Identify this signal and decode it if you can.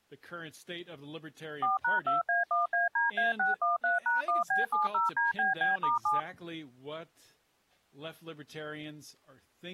DTMF, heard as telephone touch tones, dialled by machine, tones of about 150 ms, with speech in English. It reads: 4#2A1ADA613#1B70DBB*7